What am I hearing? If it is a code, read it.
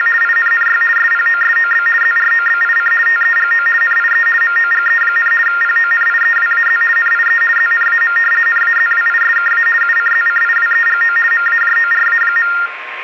RTTY (50 baud, 450 Hz shift), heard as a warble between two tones, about 1600 Hz centre, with radio static, a steady whistle near 1060 Hz and room echo. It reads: … INNY SPOSOB ZROBIC TEGO NIE MOGE, PONIEWAZ NIE ZNAM NAZWISKA UCZCIWEGO MAJORA.